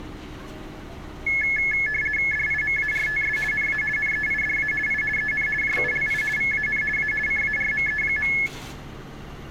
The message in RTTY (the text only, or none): DIMARTS NA NEIDA I EN JULI VAN A CARME.